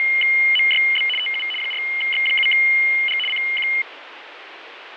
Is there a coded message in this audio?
Yes: RTTY (75 baud, 850 Hz shift) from 0.0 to 3.8 s, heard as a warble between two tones, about 2550 Hz centre, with radio static and fading. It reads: … TU 4X7G CQ